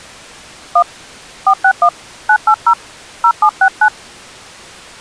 DTMF, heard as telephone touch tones, dialled by hand, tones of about 70 ms. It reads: 1 461 980 0769